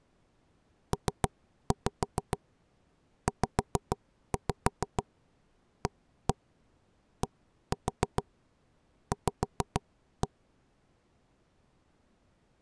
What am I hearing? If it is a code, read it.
Tap code, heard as knocks on wood, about 6 knocks a second. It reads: PZADV